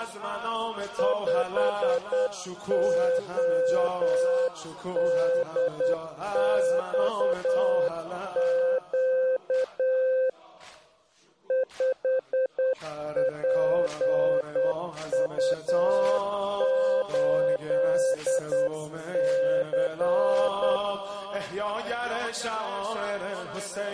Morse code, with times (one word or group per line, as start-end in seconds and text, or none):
1.0-10.3 5ODXQ
11.5-20.8 5PU8C